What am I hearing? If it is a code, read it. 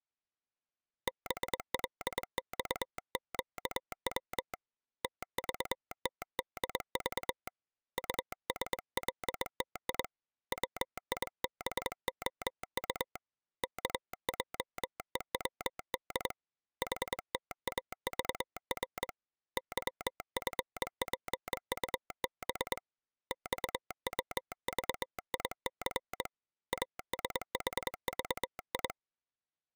Morse code, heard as a telegraph sounder, hand-sent with a straight key, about 22 wpm. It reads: BLXQW TVTDV USLTI WIBOU KJEWD HTAVR YFPUB XWVIC ASHVI